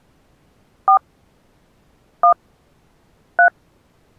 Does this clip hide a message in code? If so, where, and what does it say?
Yes: DTMF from 0.9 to 3.5 s, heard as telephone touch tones, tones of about 90 ms. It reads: 4 1 3